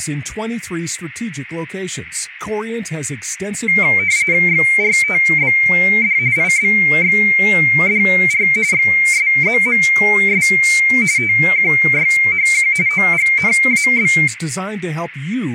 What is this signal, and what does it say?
RTTY (45.45 baud, 170 Hz shift), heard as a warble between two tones, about 2200 Hz centre, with radio static and speech in Spanish. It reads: XRTBD IBXDR XSZMS TQYHQ OGNAB